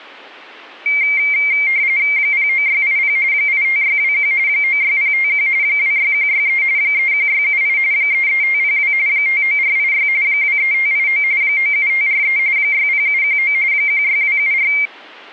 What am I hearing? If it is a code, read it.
RTTY (45.45 baud, 170 Hz shift), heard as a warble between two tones, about 2200 Hz centre. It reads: 09680 85621 96051 26163 31678 33502 59486 23589 97543 60719 16274